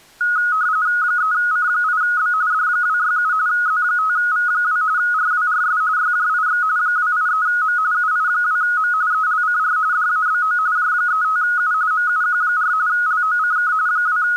RTTY (45.45 baud, 170 Hz shift), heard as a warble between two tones, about 1360 Hz centre. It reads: 3C8B D267 Z5V2 RWRS YJIX 283M UI2M ELCR DABO J35U MUQ4 LOCK …